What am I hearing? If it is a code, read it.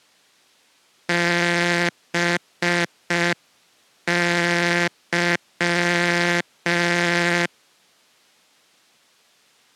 Morse code, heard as a buzzer, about 5 wpm. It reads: BY